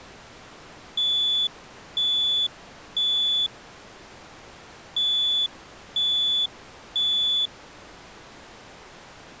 Alarm pattern, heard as an alarm's beeps, played twice, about 3450 Hz. Temporal three. Smoke or fire, evacuate.